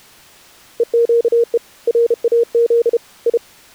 Morse code (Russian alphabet), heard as a keyed tone, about 32 wpm, 470 Hz. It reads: ЕЩЕ РАЗ И